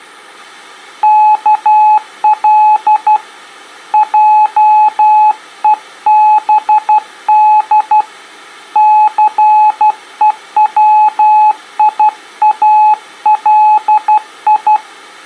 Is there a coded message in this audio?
Yes: Morse code (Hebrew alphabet) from 1.0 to 14.8 s, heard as a keyed tone, hand-sent with a paddle, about 12 wpm, 850 Hz. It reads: כל עובד סוציאלי